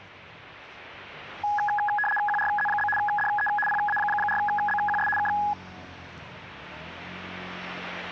RTTY (75 baud, 850 Hz shift), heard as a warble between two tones, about 1250 Hz centre, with the noise of a residential street. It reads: QRZ? DE PA4BQS K